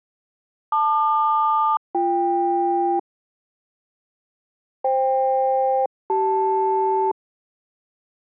Aircraft SELCAL, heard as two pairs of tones. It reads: LQ-BK FK-CL